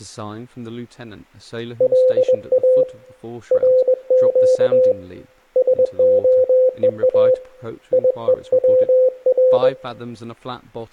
Morse code (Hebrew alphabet), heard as a keyed tone, hand-sent with a paddle, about 21 wpm, 510 Hz, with speech in English. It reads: לא רק שהוא יוצר